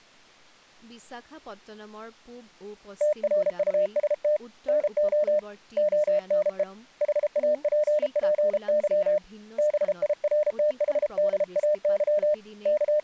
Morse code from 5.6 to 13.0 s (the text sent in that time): ONE HAPPY BIRTHDAY …